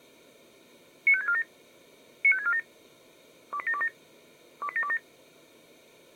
Five-tone selective call (ZVEI), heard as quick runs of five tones, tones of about 70 ms. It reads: 95647 95647 28727 28727